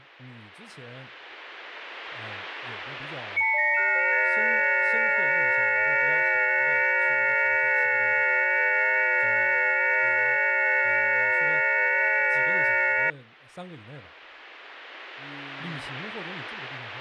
FT8 (several signals at once), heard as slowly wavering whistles, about 6.25 baud, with speech in Chinese.